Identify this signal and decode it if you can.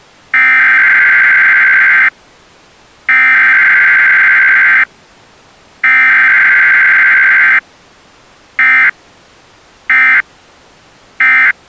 Emergency Alert System (SAME) tones (header bursts, then end-of-message bursts), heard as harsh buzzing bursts, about 520.83 baud.